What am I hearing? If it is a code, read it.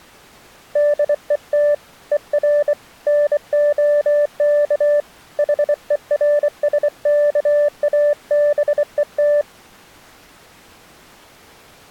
Morse code, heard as a keyed tone, hand-sent with a bug key, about 24 wpm, 590 Hz. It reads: DET ER NOK HERSKABET